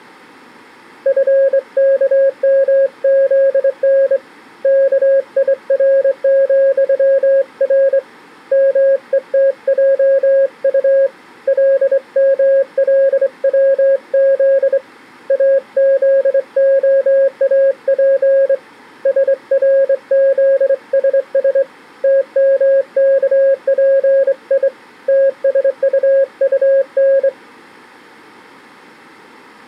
Morse code, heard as a keyed tone, hand-sent with a straight key, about 24 wpm, 540 Hz. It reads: FKMZN KIR,R METJU LMLWZ AZOAP SRZSS TMKPI TSUUN